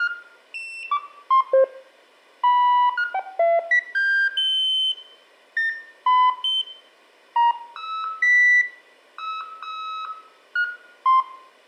Electronic bleeps of random pitch and length, with room echo. There is no code.